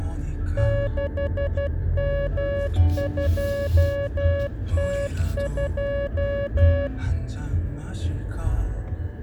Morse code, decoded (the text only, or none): 6M2T2